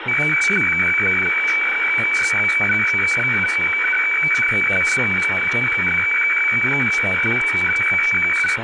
Weather fax (radiofax), 120 lines a minute, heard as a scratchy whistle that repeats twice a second, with radio static, room echo and speech in English.